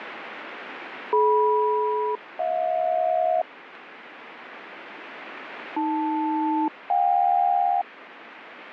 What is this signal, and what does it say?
Aircraft SELCAL, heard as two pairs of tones, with radio static. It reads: DM-HJ AL-JK